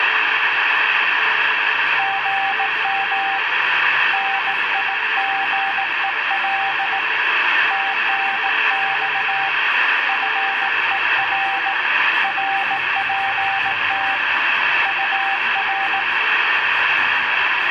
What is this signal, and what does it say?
Morse code, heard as a keyed tone, hand-sent with a bug key, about 18 wpm, 780 Hz, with radio static. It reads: GM NIGEL TNX FER RPT UR